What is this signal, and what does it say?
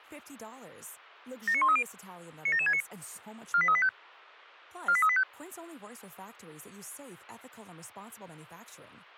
Five-tone selective call (ZVEI), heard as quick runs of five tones, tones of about 70 ms, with speech in English. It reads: 79130 97769 48385 48385